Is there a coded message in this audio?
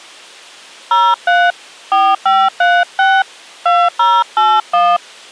Yes: DTMF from 0.9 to 5.0 s, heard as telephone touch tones, dialled by hand, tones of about 230 ms. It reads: 03 4536 2081